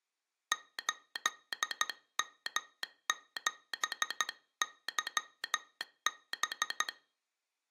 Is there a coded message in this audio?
Yes: Morse code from 0.5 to 6.9 s, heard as a telegraph sounder, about 13 wpm. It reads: 8M7YB